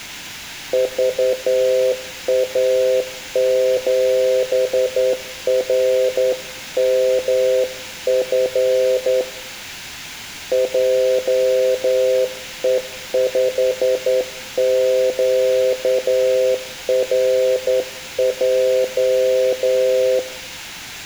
Morse code, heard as a keyed tone, hand-sent with a straight key, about 10 wpm, 510 Hz, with room echo. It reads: VA7RMF JE5QRJ